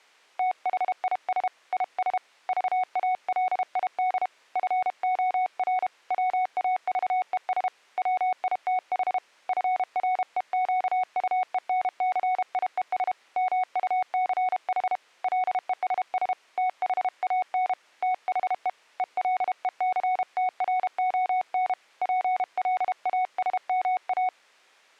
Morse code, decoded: THIS IS VALID FOR WAVES WITH FREQUENCIES MUCH LESS THAN THE ELECTRON PLASMA

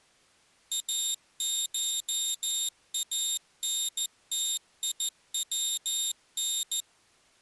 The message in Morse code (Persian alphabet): اشانتیون

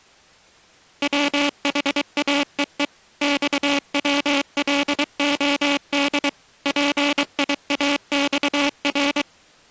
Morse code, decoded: WHAEE XWLOD PIAXR

